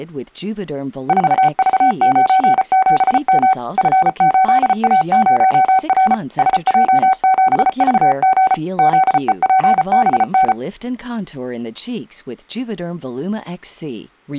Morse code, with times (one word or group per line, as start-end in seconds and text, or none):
1.1-3.5 4V97M
3.8-6.1 F8A0R
6.4-8.5 SJ7VG
8.8-10.5 ZEPBN